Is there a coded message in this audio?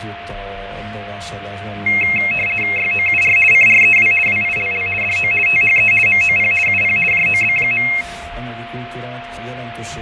Yes: RTTY (50 baud, 450 Hz shift) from 1.9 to 8.0 s, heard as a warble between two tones, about 2350 Hz centre, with radio static, fading and a steady whistle near 690 Hz. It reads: YOUR CREW WILL DO THE MOP UP JOB.